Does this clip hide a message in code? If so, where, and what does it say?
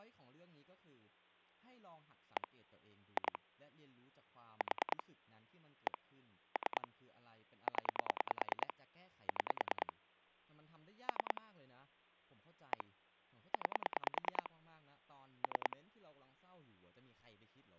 Yes: pulse dialling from 2.4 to 15.7 s, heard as clicks on a phone line, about 10 pulses a second, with speech in Thai. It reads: 1 2 4 1 3 0 6 3 1 9 3